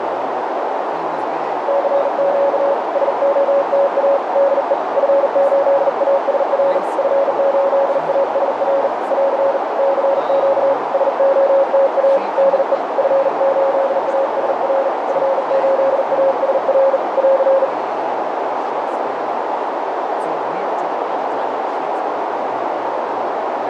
Morse code, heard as a keyed tone, hand-sent with a bug key, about 39 wpm, 550 Hz, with heavy radio static, a narrow filter and speech in English. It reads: CQ SOTA DE F8ASR F8ASR <AR> CQ SOTA DE F8ASR F8ASR <AR>